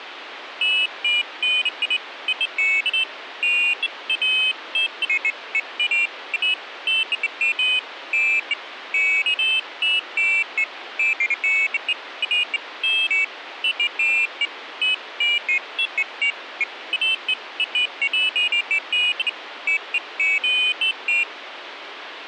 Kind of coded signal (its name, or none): none